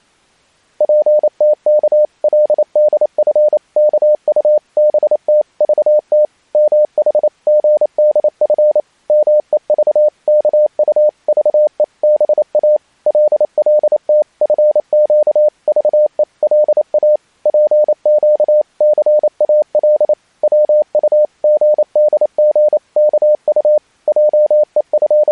Morse code (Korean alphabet), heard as a keyed tone, machine-sent, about 28 wpm, 600 Hz. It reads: 정근이더러 무슨 말이라도 꺼내라고 재촉 비슷이 …